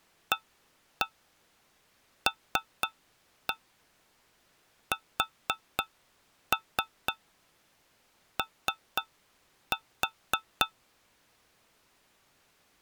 Tap code, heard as taps on a metal pipe, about 4 knocks a second. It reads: ALSO